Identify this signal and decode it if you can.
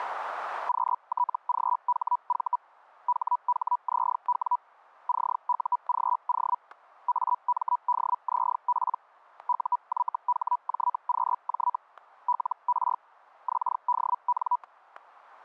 Hellschreiber (Feld-Hell, 122.5 baud), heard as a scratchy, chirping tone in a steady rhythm, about 980 Hz, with static crashes. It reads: QTGHV HHZW CUGO AMDZP UYHJQJ LR XDN